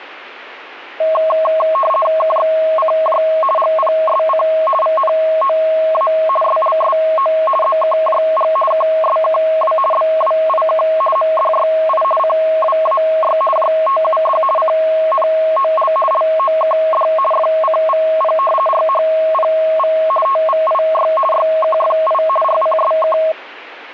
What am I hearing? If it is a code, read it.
RTTY (50 baud, 450 Hz shift), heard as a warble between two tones, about 860 Hz centre. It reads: KXCJ GPSC VNOA SLSO ZKJG KSKW BWIK MDYI CWAY JTUD CNOL LOKD FCVP RHPV TVIY YKFI RCSK